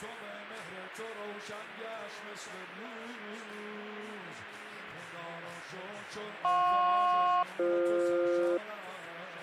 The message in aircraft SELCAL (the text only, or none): JP-BF